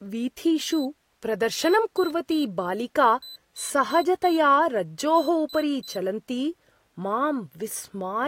Beep code, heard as a piezo beeper, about 4000 Hz, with speech in Sanskrit. 1-3-4-3. In Phoenix BIOS tables: memory failure on data bits.